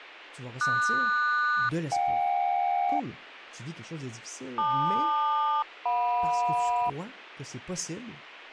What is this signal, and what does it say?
Aircraft SELCAL, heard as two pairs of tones, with speech in French. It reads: QS-JK LQ-JM